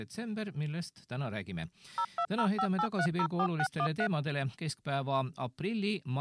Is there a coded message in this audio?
Yes: DTMF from 2.0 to 4.1 s, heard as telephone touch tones, dialled by machine, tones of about 70 ms. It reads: 02058304613